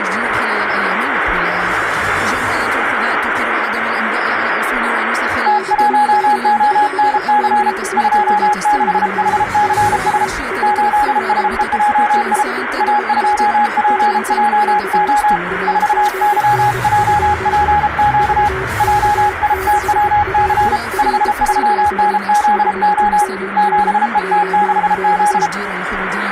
Morse code, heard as two keyed tones, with radio static. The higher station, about 33 wpm, 830 Hz: T1ONC 26HCS 8SEJI A2PJO 4YJPQ JITWC 53NZO 7ET6Z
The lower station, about 23 wpm, 380 Hz: BD5ZM/QRP 5NN OK AGN? VK6LRQ 5NN OK